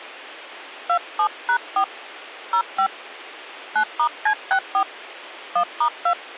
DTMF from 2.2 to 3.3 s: 05

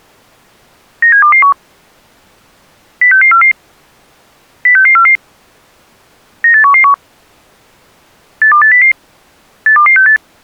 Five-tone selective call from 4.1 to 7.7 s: 06644 98111

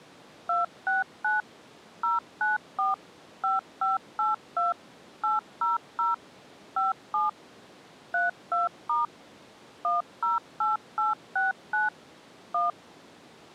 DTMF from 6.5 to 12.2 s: 57 32* 108869

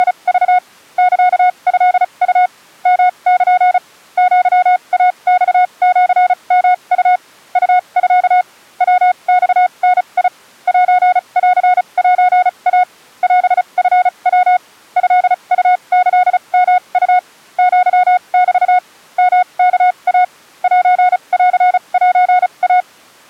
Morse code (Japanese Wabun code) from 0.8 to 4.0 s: サトウ ヨル

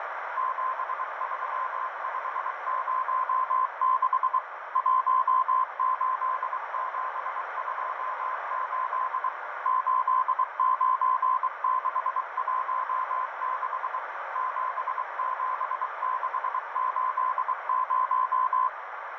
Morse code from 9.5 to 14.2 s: 89616

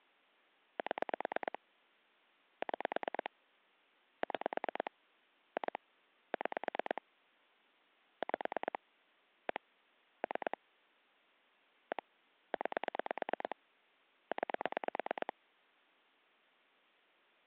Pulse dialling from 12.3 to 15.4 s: 9 9

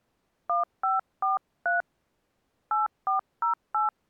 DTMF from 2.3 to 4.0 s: 8408

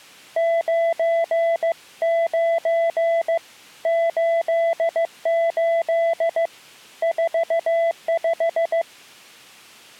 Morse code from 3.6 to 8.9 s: 88 45

